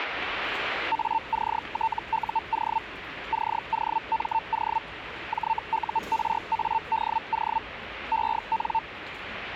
Hellschreiber (Feld-Hell, 122.5 baud), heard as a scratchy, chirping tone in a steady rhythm, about 900 Hz, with radio static and the noise of a subway station. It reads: ACTUO COMO JURADO EN